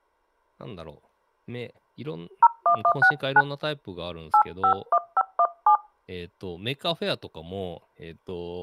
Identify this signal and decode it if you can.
DTMF, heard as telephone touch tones, dialled by hand, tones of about 80 ms, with speech in Japanese. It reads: 01169 851517